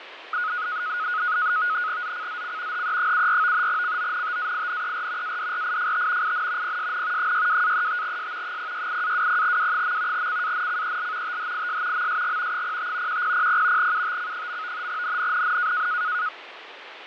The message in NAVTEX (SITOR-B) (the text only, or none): ZCZC HE74 CONTAINER ADRIFT IN PSN 62-35S 068-20W. CANCEL THIS MSG 05 1000 UTC. NNNN